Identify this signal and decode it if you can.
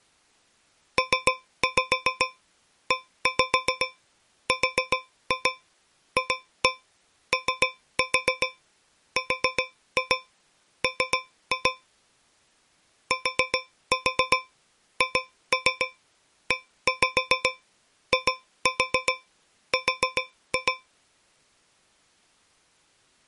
Tap code, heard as taps on a metal pipe, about 7 knocks a second. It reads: PERFORM THEIR